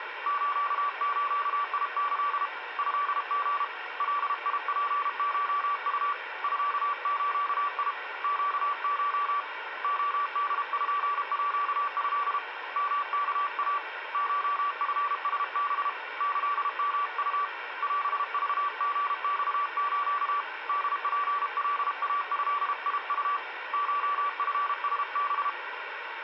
Morse code (Japanese Wabun code), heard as a keyed tone, hand-sent with a paddle, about 32 wpm, 1150 Hz, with radio static and a weaker station near 740 Hz. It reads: スズキ トリ ガツコウ ミズ ネコ レポート ヨワイ コチラハ キヨウ オクリマス ホツカイドウ コチラハ